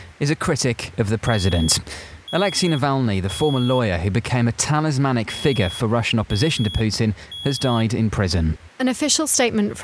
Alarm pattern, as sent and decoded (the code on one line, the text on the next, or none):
3 beeps and a pause
temporal three